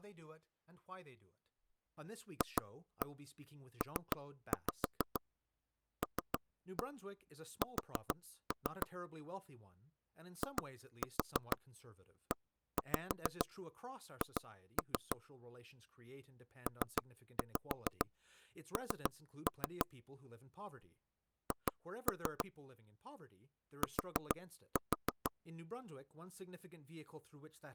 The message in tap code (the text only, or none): FPLS IEH PN H T